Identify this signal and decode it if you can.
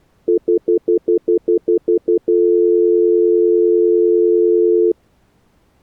Telephone call progress tone (North American plan), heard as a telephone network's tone, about 350, 440 Hz, 0.1 s on and 0.1 s off. Stutter dial tone.